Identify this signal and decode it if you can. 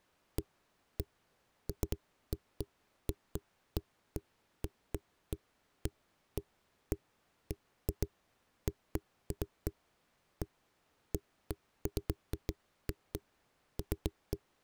Irregular knocks on a wall. There is no code.